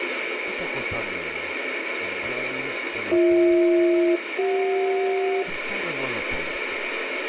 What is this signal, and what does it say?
Aircraft SELCAL, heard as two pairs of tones, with radio static and speech in Italian. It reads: BH-CJ